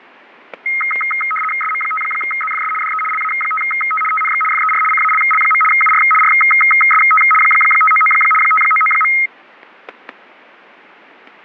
RTTY (75 baud, 850 Hz shift), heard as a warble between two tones, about 1700 Hz centre, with fading and static crashes. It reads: SM5ZFS DE LA5T TNX FER CALL. UR RST 599 599.